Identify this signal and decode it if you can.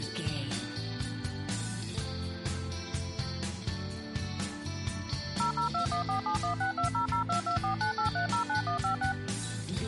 DTMF, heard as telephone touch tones, dialled by machine, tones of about 110 ms. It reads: 0021471620022498309156